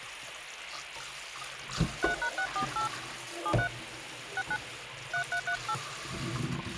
DTMF, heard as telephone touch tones, dialled by hand, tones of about 80 ms, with phone line noise and kitchen noise. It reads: 3#648 73 69 3338